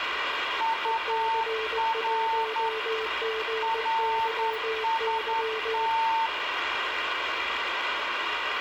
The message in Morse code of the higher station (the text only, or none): UR RST